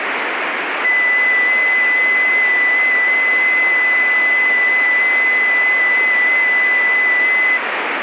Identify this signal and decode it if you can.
FT8 (one signal), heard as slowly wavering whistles, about 6.25 baud, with radio static.